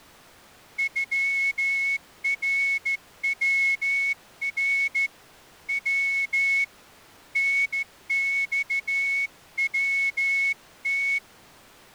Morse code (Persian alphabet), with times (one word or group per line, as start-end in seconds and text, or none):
0.8-5.1 غرور
5.7-6.6 و
7.4-11.2 نخوت